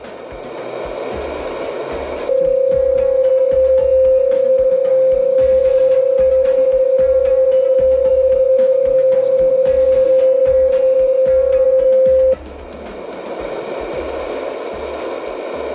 PSK31 (31.25 baud), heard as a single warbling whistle, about 520 Hz, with radio static.